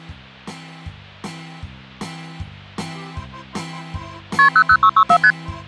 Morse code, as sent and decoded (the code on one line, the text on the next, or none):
none